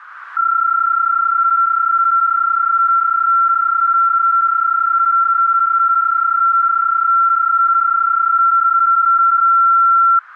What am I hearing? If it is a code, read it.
PSK31 (31.25 baud), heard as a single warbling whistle, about 1360 Hz.